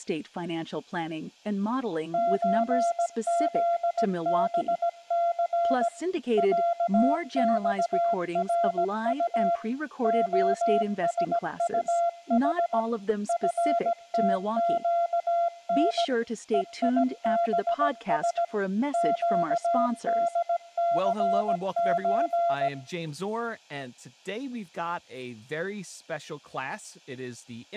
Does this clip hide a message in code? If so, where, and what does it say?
Yes: Morse code (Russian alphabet) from 2.1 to 22.7 s, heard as a keyed tone, machine-sent, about 17 wpm, 680 Hz, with room echo and speech in English. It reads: ЧЗБЦ ЯЬРУ ОСУХ ФТЩН ЕИБС ЩДЦЧ